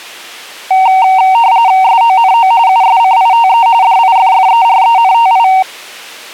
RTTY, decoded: SONO USCITE DIFFERENTI

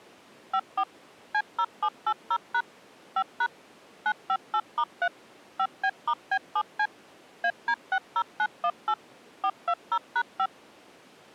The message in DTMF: 54 C0780# 5# 958*3 5B*B7C AD60918 420#5

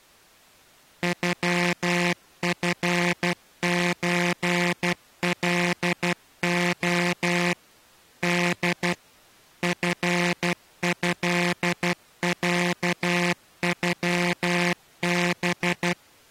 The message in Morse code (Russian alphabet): ЮФЧЛО Д ФЭЯЮБ

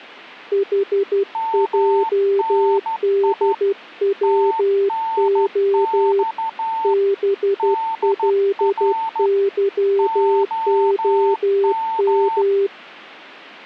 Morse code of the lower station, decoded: HJDWO BLYOM

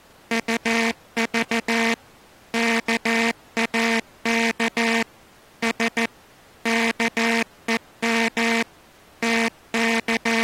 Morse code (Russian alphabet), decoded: УЖ КАК С КЕМ …

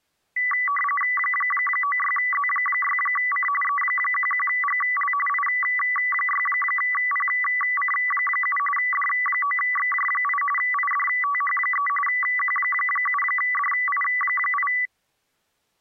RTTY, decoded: 96Z6C E11GL I6PC7 D9XJ8 IDTH3 Q7DI8

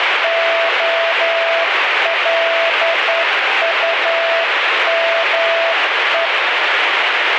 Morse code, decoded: OLUME

